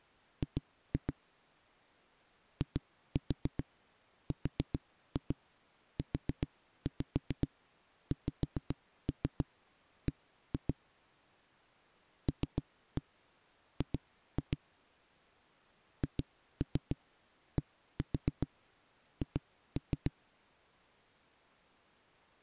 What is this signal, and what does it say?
Tap code, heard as knocks on a wall, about 7 knocks a second. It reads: G IRUXB LG HDH